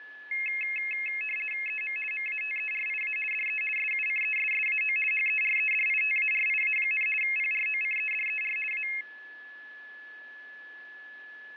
RTTY (50 baud, 450 Hz shift), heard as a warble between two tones, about 2350 Hz centre, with a steady whistle near 1720 Hz. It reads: EM MATERIA DE SUCESSAO HEREDITARIA, PROCEDER A